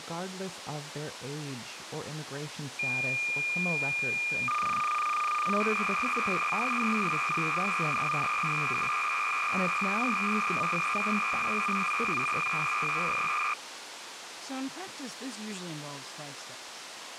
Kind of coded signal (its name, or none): cassette data (Kansas City type)